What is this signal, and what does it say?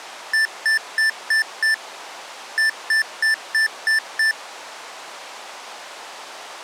Beep code, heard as beeps from a small speaker, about 1750 Hz. 5-6.